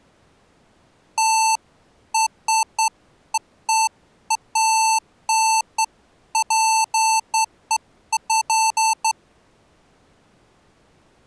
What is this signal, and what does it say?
Beeps of irregular length. There is no code.